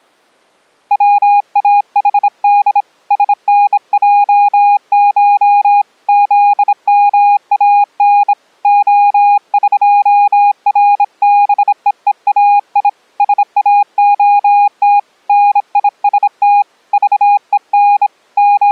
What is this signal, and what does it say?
Morse code (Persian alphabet), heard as a keyed tone, hand-sent with a bug key, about 26 wpm, 820 Hz. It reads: واحد سنجش زمان عقربههای ساعت نیست ذهن …